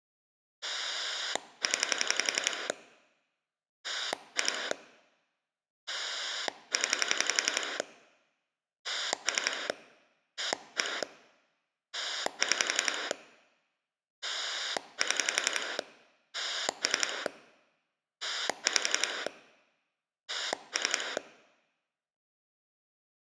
Pulse dialling, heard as a rotary dial, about 11 pulses a second. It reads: 0 2 0 3 1 6 7 3 5 3